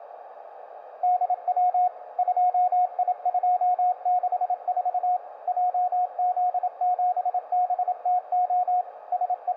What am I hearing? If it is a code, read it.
Morse code, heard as a keyed tone, machine-sent, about 27 wpm, 720 Hz, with radio static, a narrow filter and room echo. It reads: DW 2I264 JZ7BTO …